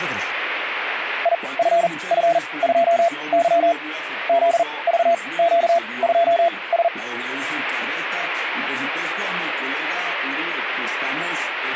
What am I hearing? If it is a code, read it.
Morse code, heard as a keyed tone, machine-sent, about 40 wpm, spaced as for 24 wpm, 680 Hz. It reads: IFF2Y ZVQ2S